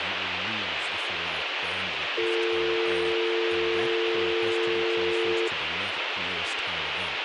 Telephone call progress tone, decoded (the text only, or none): dial tone